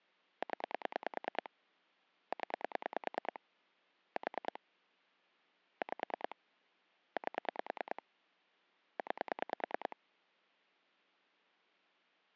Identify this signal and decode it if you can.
Pulse dialling, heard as clicks on a phone line, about 9 pulses a second. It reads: 0 0 4 5 8 9